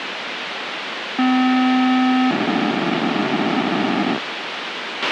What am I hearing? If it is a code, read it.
POCSAG pager data (512 baud), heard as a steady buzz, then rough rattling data, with radio hiss and a squelch burst at the end.